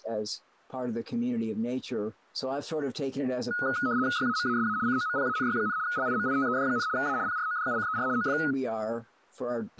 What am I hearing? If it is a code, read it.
RTTY (75 baud, 170 Hz shift), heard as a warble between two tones, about 1360 Hz centre. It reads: YAMASA COMPANY, LIMITED, A PRODUCER OF